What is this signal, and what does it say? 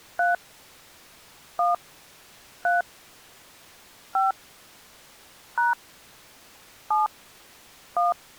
DTMF, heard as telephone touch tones, dialled by hand, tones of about 160 ms. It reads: 3 1 3 5 # 7 1